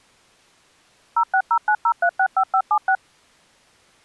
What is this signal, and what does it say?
DTMF, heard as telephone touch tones, dialled by machine, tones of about 70 ms. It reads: 06090365576